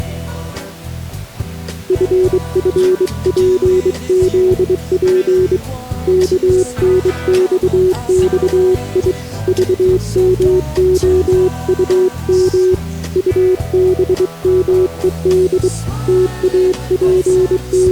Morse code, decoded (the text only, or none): FFPZP KNXXI VMOUM UBMED …